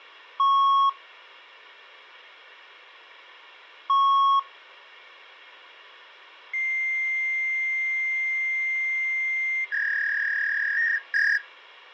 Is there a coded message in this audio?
Yes: fax machine handshake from 0.4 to 11.4 s, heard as beeps, a long tone and a warble, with phone line noise.